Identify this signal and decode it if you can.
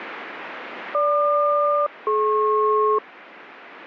Aircraft SELCAL, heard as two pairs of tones, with radio static. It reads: GQ-DP